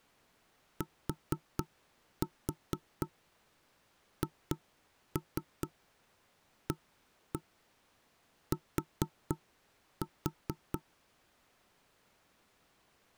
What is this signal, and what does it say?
Tap code, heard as knocks on wood, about 4 knocks a second. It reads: THAT